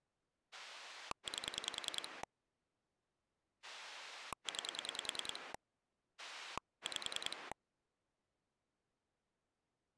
Pulse dialling, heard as a rotary dial, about 10 pulses a second. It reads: 8 9 5